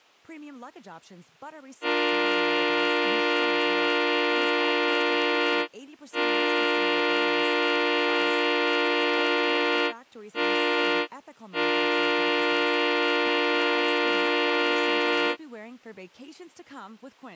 Train horn signal, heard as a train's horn, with speech in English. 2 long, 1 short, 1 long. On North American railways: approaching a public crossing.